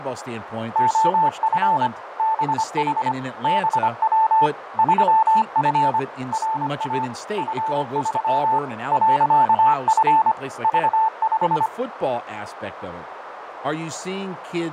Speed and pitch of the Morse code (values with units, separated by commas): 25 wpm, 880 Hz